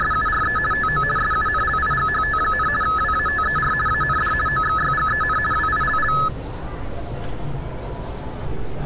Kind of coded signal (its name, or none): RTTY